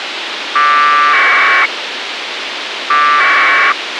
Packet radio (AX.25, as in APRS), 1200 baud, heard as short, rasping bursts, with radio hiss and a squelch burst at the end.